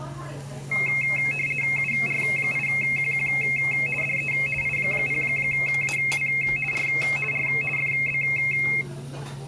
RTTY (50 baud, 450 Hz shift), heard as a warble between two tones, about 2350 Hz centre, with the noise of a restaurant. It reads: UR8QQ DE I0AW R R FB